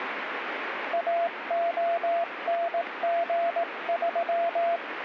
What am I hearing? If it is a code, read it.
Morse code, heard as a keyed tone, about 18 wpm, 680 Hz, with radio static. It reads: AONG3